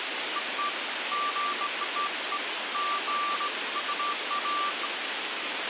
Beeps of irregular length, with radio hiss and a squelch burst at the end. There is no code.